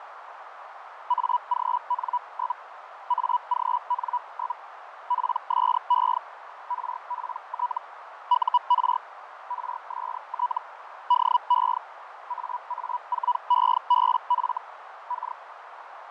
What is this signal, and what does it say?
Hellschreiber (Feld-Hell, 122.5 baud), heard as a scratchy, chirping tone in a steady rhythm, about 980 Hz, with radio static, fading and a narrow filter. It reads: AGN? AGN? PSE RPT UR RST DE AA4EBF K